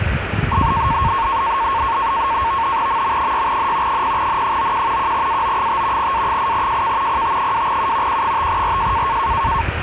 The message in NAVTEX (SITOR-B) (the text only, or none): MM6N 0N91 1AO5 A8JK PT2U Q5RJ